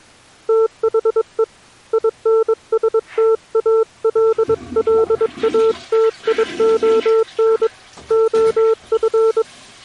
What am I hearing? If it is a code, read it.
Morse code, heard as a keyed tone, hand-sent with a paddle, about 22 wpm, 450 Hz, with the noise of a restroom. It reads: THE INSTALLATION OF